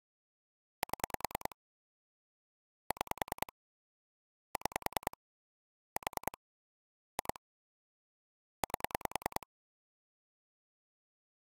Pulse dialling, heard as clicks on a phone line, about 10 pulses a second. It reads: 7 6 6 4 2 8